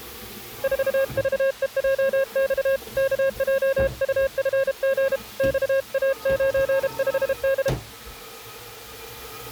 Morse code, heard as a keyed tone, hand-sent with a paddle, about 32 wpm, 540 Hz, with kitchen noise. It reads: 4VEJX KJUFG XA95D